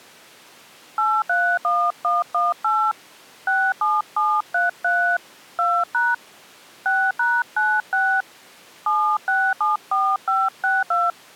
DTMF, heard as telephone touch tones, dialled by hand, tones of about 240 ms. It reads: 831118 67733 2# 6#96 7674562